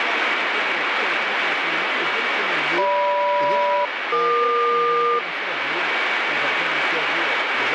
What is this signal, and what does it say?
Aircraft SELCAL, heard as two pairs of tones, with radio static. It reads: GM-EQ